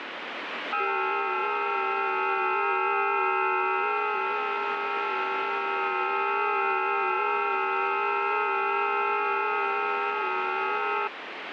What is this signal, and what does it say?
FT8 (several signals at once), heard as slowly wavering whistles, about 6.25 baud, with radio static.